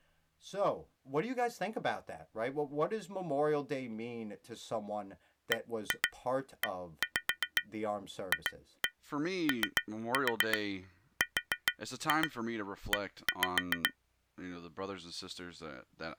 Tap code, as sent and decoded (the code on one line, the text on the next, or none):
1-2 1-5 2-1 3-4 4-2 1-5
BEFORE